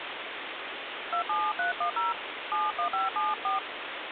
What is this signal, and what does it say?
DTMF, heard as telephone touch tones, dialled by hand, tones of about 160 ms, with phone line noise. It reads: 27310 71574